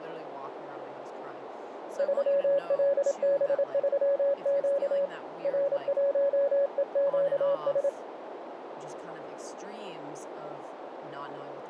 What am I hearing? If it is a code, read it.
Morse code, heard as a keyed tone, hand-sent with a paddle, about 27 wpm, 560 Hz, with radio static, a narrow filter and speech in English. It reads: 3LB3Q R1EQS